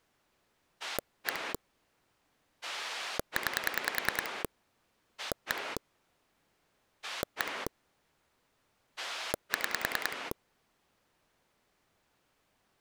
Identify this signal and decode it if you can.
Pulse dialling, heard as a rotary dial, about 10 pulses a second. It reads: 1 9 1 1 6